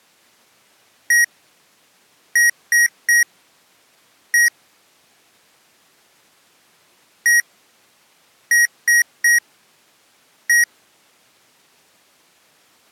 Beep code, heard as beeps from a small speaker, played twice, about 1900 Hz. 1-3-1. In Phoenix BIOS tables: memory refresh failure.